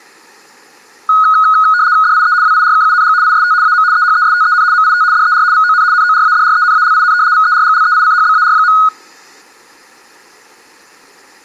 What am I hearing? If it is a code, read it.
RTTY (75 baud, 170 Hz shift), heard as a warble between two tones, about 1360 Hz centre, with room echo. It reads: DIE WIRKUNG IST AM EHESTEN MIT DER VON NORADRENALIN VERGLEICHBAR.